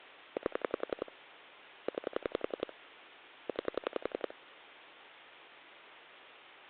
Pulse dialling, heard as clicks on a phone line, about 11 pulses a second. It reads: 8 9 9